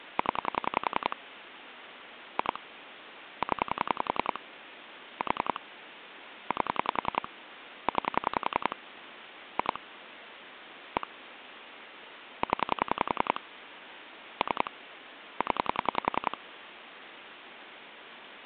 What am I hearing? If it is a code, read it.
Pulse dialling, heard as clicks on a phone line, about 10 pulses a second, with phone line noise. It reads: 0 2 0 4 8 9 2 1 0 3 0